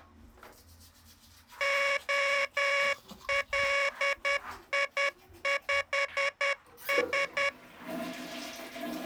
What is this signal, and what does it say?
Morse code, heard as a buzzer, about 10 wpm, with the noise of a restroom. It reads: OLI5S